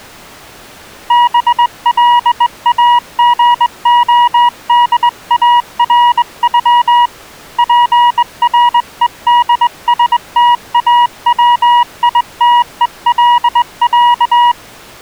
Morse code (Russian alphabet), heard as a keyed tone, hand-sent with a straight key, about 20 wpm, 960 Hz. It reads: БЛАГОДАРЮ ПРЕДСТАВИТЕЛЯ